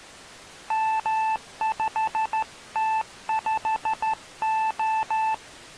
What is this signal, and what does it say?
Morse code, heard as a keyed tone, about 13 wpm, 880 Hz. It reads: M5T5O